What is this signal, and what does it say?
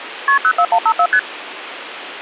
Multi-frequency trunk signalling (R1, as on North American trunks), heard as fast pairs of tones, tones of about 70 ms, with phone line noise. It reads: KP 04154 ST